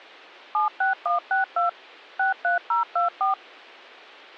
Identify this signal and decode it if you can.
DTMF, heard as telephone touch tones, dialled by machine, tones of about 130 ms. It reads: 76162 63024